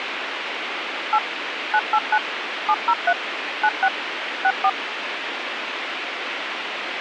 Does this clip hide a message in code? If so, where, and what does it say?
Yes: DTMF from 1.1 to 4.7 s, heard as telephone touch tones, dialled by machine, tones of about 60 ms, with radio hiss. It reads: 8 989 703 96 64